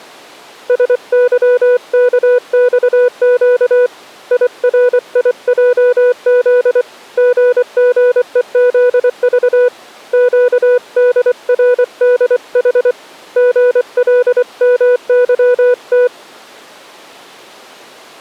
Morse code, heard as a keyed tone, hand-sent with a paddle, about 24 wpm, 490 Hz. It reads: SYKXQ IRIJZ GGEZV QDRDH GLMYT